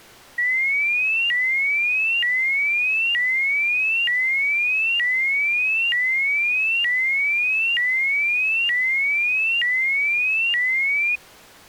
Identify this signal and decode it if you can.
A tone that sweeps in pitch again and again. There is no code.